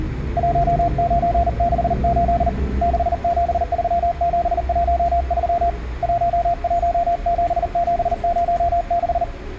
Morse code, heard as a keyed tone, hand-sent with a paddle, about 39 wpm, 690 Hz, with room echo and the noise inside a bus. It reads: 1968 673713 117706